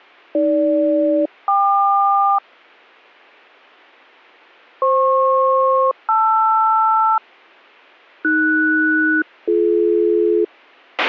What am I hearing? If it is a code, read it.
Aircraft SELCAL, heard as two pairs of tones, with a squelch burst at the end. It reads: AG-KQ FP-LR AS-BD